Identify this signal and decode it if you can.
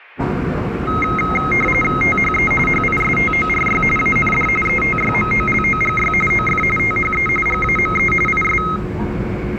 RTTY (45.45 baud, 850 Hz shift), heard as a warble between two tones, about 1700 Hz centre, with the noise inside a subway train. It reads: THE HISTORY AND ETYMOLOGY OF THE GAME IS